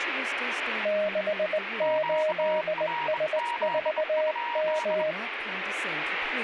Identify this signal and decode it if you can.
Morse code, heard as two keyed tones, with radio static and speech in English. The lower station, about 20 wpm, 620 Hz: 68S4M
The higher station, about 24 wpm, 950 Hz: QRZ?